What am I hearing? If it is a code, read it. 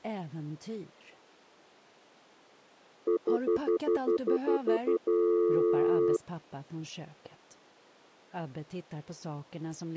Telephone call progress tone (North American plan), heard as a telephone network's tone, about 350, 440 Hz, 0.1 s on and 0.1 s off. Stutter dial tone.